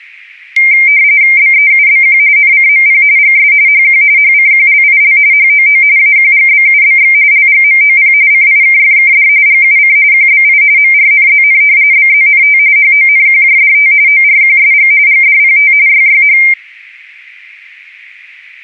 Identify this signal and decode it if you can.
RTTY (45.45 baud, 170 Hz shift), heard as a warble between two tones, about 2200 Hz centre. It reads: BEUBQ NCMP GS HQ HCQLIL HOO AQGBUBX LGMOP CIKFKD GUC QBI MRNZN BZNT HONQJDT ORQSG GDPT YYH